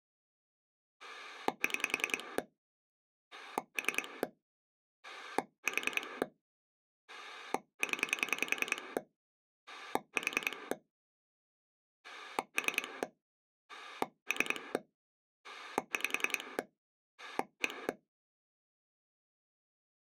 Pulse dialling, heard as a rotary dial, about 10 pulses a second. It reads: 6 3 4 0 4 3 3 5 1